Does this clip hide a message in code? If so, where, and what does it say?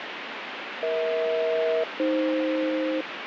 Yes: aircraft SELCAL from 0.8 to 3.0 s, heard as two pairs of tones, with radio static. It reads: EH-AF